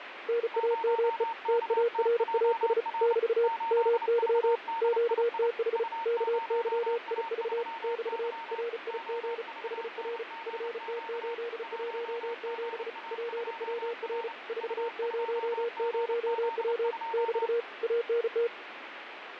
Morse code, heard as two keyed tones, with radio static and fading. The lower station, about 35 wpm, 470 Hz: NAME TARAS <BT> MY QTH KYIV <BT> RIG HR FT817 PWR 400W <BT> ANT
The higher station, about 29 wpm, 910 Hz: 0KTJR 8VDII U0A3Y OVNGQ 1GA2R U2GZ2